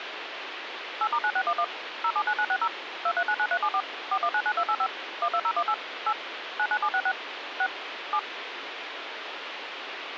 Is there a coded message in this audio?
Yes: DTMF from 1.0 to 8.2 s, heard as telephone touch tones, dialled by machine, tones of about 60 ms, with phone line noise. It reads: 8*9611 079960 2399374 4199285 12018 8 99766 6 7